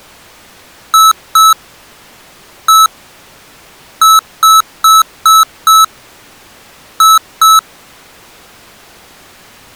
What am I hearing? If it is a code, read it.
Beep code, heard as beeps from a small speaker, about 1300 Hz. 2-1-5-2.